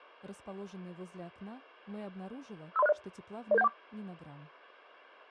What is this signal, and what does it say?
Five-tone selective call (EIA), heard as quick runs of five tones, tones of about 30 ms. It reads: 53060 00714